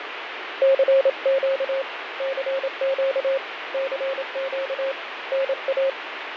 Morse code, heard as a keyed tone, hand-sent with a paddle, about 27 wpm, 540 Hz, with radio static and fading. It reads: CQ CQ CQ NA